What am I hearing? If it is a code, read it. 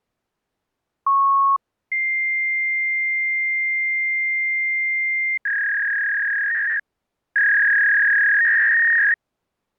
Fax machine handshake, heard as a beep, a long tone and a warble.